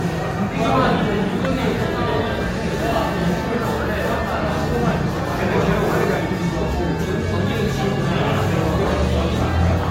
The noise of a restaurant. There is no code.